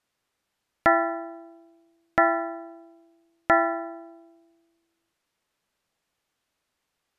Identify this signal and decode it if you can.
Clock strike, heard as a bell. 3. Three o'clock.